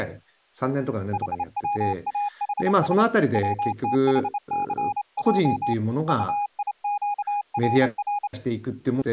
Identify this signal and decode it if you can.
Morse code, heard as a keyed tone, hand-sent with a straight key, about 27 wpm, 820 Hz, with speech in Japanese. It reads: HWAHS WTHCJ UIQRR